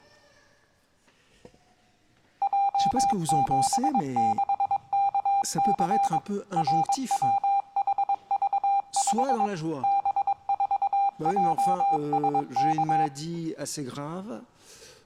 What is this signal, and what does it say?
Morse code, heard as electronic beeps, machine-sent, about 22 wpm, 800 Hz. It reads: J76KC RWHV5 B4JSK